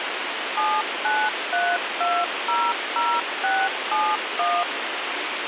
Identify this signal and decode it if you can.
DTMF, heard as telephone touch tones, dialled by machine, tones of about 240 ms, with radio hiss. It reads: 793200671